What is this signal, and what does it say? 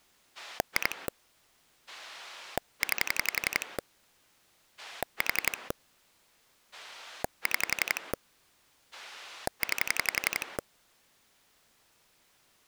Pulse dialling, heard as a rotary dial, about 11 pulses a second. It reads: 2 9 4 6 9